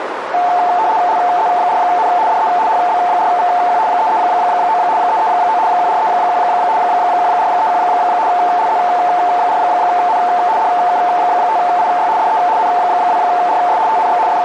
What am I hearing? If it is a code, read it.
RTTY (75 baud, 170 Hz shift), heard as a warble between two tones, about 800 Hz centre, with radio static and a narrow filter. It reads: LZ4N DE HB4VQ 339 339 1431 1431 LZ4N DK5IY DE N2RS TNX …